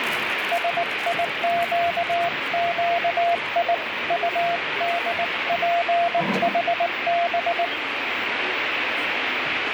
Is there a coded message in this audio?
Yes: Morse code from 0.5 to 7.7 s, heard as a keyed tone, hand-sent with a bug key, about 19 wpm, 690 Hz, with radio static and the noise of a crowd indoors. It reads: SIQQI UDPHB